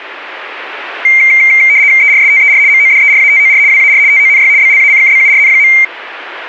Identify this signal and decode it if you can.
RTTY (75 baud, 170 Hz shift), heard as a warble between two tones, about 2200 Hz centre. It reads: ERSTER MODERATOR WAR TONY BLACKBURN.